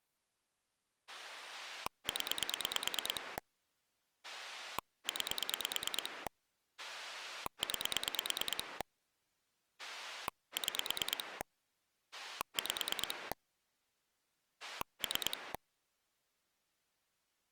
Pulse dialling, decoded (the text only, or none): 0 9 9 6 5 3